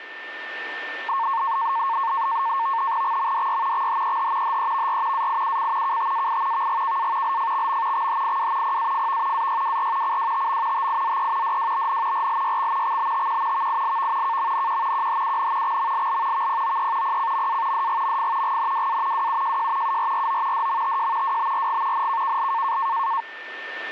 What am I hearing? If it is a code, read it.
NAVTEX (SITOR-B), 100 baud, 170 Hz shift, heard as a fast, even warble, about 1000 Hz centre, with a steady whistle near 1790 Hz. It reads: XMDY XHEH HEVR AIUC KTAI VGKA LFXM XHIW PAFV AYWR CWTM TIZE DWBN RLYX XBTQ VILV KMNQ QHUN XMLL VPOE PCMA DGMF GNWA WUJJ URRO DMTJ WBRG NKKL